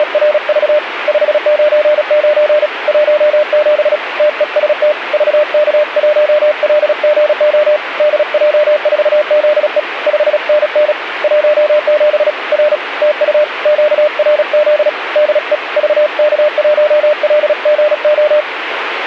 Morse code, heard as a keyed tone, hand-sent with a paddle, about 36 wpm, 600 Hz, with radio static. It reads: … 599 17 TEST VK1LGO DJ4ZE 5NN 17 R TU QRZ DE VK1LGO